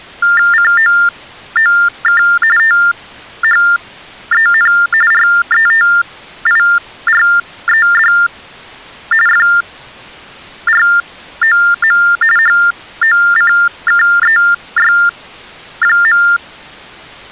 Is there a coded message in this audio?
Yes: TTY/TDD text telephone tones (45.45 baud Baudot) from 0.2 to 16.4 s, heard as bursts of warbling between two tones, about 400 Hz shift, 1600 Hz centre. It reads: COOK THEN RETIRED FROM HOCKEY.